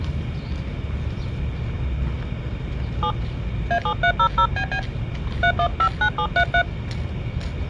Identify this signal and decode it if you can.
DTMF, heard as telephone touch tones, dialled by hand, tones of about 80 ms, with the noise of a park. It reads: 7 A7300BB 3159733